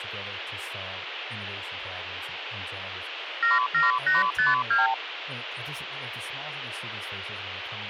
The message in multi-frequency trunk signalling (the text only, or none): 77852